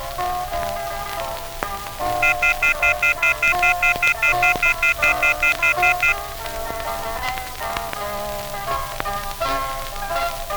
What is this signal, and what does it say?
Telephone call progress tone (North American plan), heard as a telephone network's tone, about 1400, 2050, 2450, 2600 Hz, 0.1 s on and 0.1 s off. Off-hook warning tone.